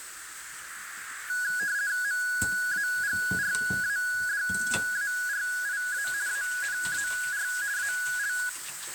RTTY (50 baud, 170 Hz shift), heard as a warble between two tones, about 1550 Hz centre, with radio static, a narrow filter and kitchen noise. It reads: MAGRADARIA ANAR AL